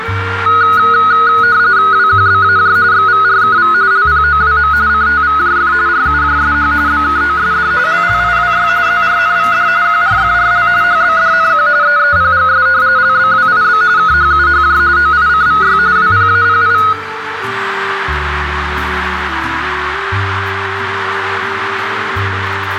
RTTY (45.45 baud, 170 Hz shift), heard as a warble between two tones, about 1360 Hz centre, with radio static and a narrow filter. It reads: WQBAJ XVRKV LPOWM CTVJF RUJSH BKOSD LLIWY ZRNVD QRFRL HBDNQ EEPGS LBWIB KHUHJ OICVY WPAPI